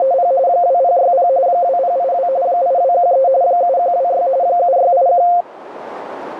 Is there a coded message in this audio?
Yes: RTTY (45.45 baud, 170 Hz shift) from 0.0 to 5.4 s, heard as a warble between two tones, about 620 Hz centre, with radio static and a narrow filter. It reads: … 2060 2082 8213 7126 7681